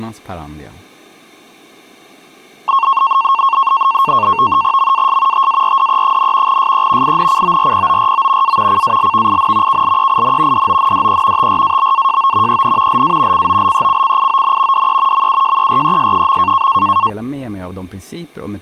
NAVTEX (SITOR-B), 100 baud, 170 Hz shift, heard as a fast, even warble, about 1000 Hz centre. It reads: MAS TARDE, SE INCORPORO A CALVIN KLEIN DONDE TRABAJO EN LA COLECCION DE MUJERES.